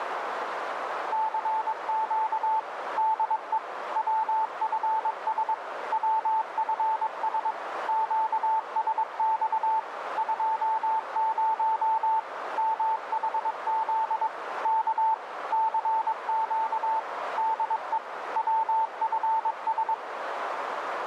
Morse code, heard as a keyed tone, machine-sent, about 22 wpm, 880 Hz, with radio static and a narrow filter. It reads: CQ DE WFS WFS QSX 20 MHZ K CQ DE WFS